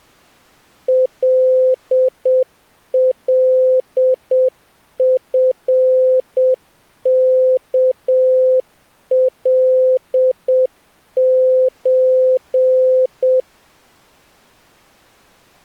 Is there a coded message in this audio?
Yes: Morse code (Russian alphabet) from 0.8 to 13.5 s, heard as a keyed tone, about 7 wpm, 520 Hz. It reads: ЛЛФКЛЧ